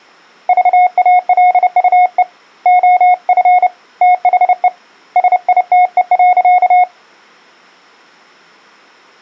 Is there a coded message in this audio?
Yes: Morse code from 0.4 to 6.9 s, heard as a keyed tone, hand-sent with a paddle, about 30 wpm, 720 Hz. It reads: VALUE OF THE SITE.